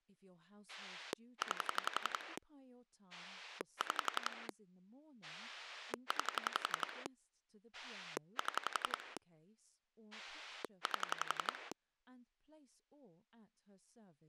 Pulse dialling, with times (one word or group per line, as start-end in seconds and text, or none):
0.7-2.4 9
3.1-4.5 6
5.2-7.1 9
7.7-9.2 7
10.1-11.7 8